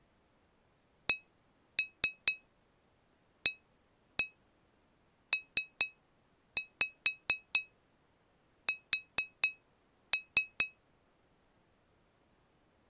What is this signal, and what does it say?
Tap code, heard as taps on glass, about 4 knocks a second. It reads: CAPS